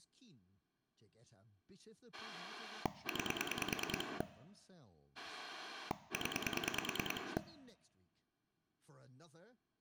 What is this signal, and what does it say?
Pulse dialling, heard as a rotary dial, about 9 pulses a second, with room echo and speech in English. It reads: 9 0